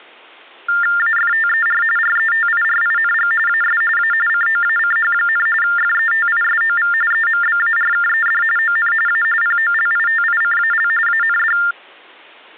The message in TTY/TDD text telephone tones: AFTER RETIRING AS A COACH, FETISOV EMBARKED ON A POLITICAL AND

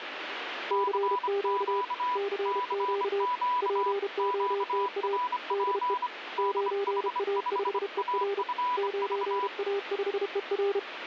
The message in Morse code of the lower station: CQ CQ POTA DE 9A5ER 9A5ER

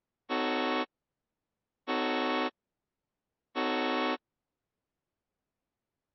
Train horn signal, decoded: 3 short

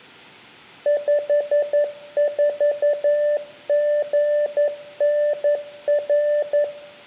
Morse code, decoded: 54GNR

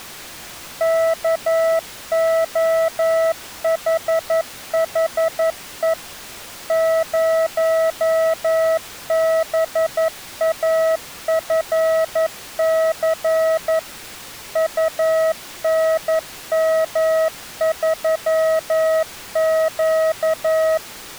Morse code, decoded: KOHHE 0BAFC UNM3Q

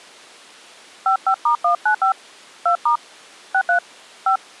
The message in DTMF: 55*195 2* 63 5

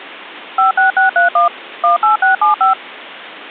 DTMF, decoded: 56631 18675

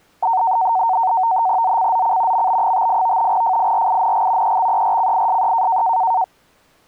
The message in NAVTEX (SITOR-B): ZCZC MB58 FIRING EXERCISE

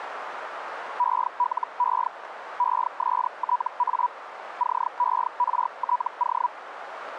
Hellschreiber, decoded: ELE ESTA CERTO

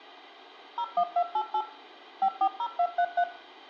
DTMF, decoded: 01288 540233

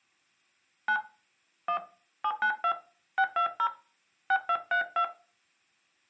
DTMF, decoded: 9 1 792 620 6232

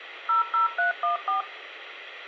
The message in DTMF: 00314

